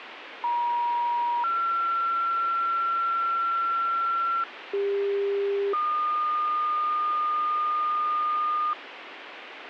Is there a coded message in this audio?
Yes: two-tone page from 0.4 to 8.7 s, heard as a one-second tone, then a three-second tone, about 950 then 1360 Hz, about 400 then 1220 Hz, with radio hiss.